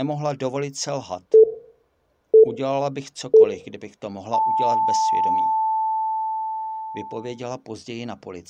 Radio time signal (three low pips and a long one an octave up, as on NHK), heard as pips, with room echo and speech in Czech.